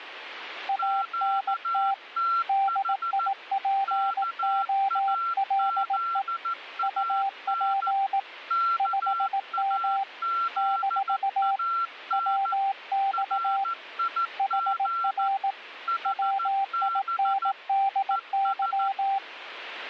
Morse code, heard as two keyed tones, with radio static. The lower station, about 18 wpm, 780 Hz: ANT DIPOLE UP 5M - WX HR WINDY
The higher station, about 14 wpm, 1360 Hz: QTH KAZAN KAZAN RIG HB ES